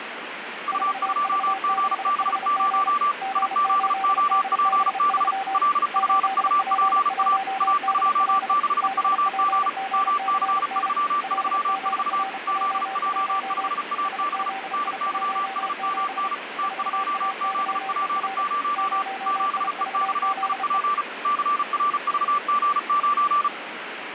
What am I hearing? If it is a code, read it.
Morse code, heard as two keyed tones, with radio static. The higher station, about 35 wpm, 1170 Hz: U2GB0 IZOPB LFUPA A26WG MC334 ZJ5AB NYSMN T2ZP0 7EXIP CRVG9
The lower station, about 32 wpm, 780 Hz: 4V6HG G8DB3 8P1DL BPGCN LGRJ1 SZI17 4AYER 0IVZE